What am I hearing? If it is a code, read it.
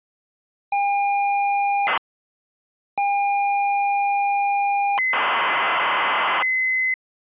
ZX Spectrum tape loading, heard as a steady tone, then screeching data.